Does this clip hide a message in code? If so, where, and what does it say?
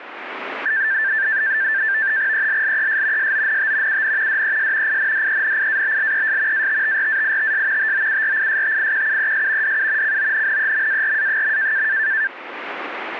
Yes: NAVTEX (SITOR-B), 100 baud, 170 Hz shift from 0.7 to 12.3 s, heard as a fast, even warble, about 1650 Hz centre. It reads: ELLES SONT UN DES INDENIABLES ATTRAITS TOURISTIQUES DU CONNEMARA.